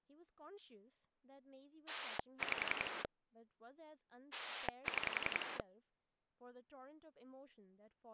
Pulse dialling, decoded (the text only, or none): 5 6